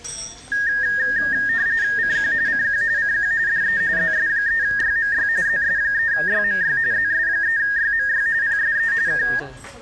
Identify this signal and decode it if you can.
RTTY (45.45 baud, 170 Hz shift), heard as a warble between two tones, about 1750 Hz centre, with room echo and the noise of a restaurant. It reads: CQ CQ CQ DE ZS3YMY ZS3YMY ZS3YMY PSE K